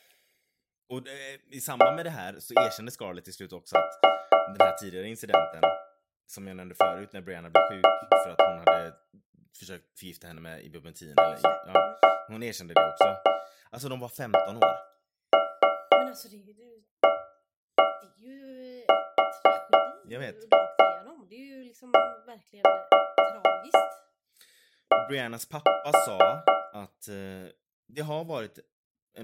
Tap code, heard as taps on a metal pipe, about 4 knocks a second, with speech in Swedish. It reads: ARE SHARED